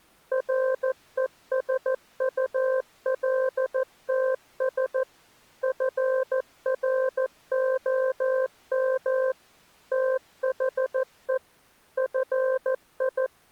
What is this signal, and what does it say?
Morse code, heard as a keyed tone, machine-sent, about 14 wpm, 520 Hz. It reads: RESULTS FROM THE …